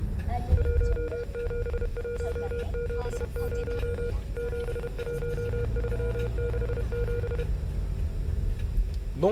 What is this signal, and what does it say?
Morse code, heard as a keyed tone, machine-sent, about 31 wpm, 480 Hz, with room echo and the noise inside a car. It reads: 17170 71367